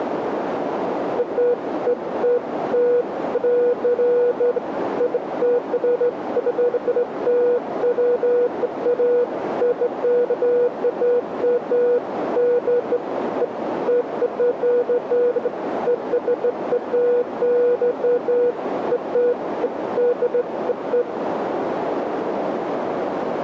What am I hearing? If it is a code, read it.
Beeps of irregular length, with radio static and a narrow filter. There is no code.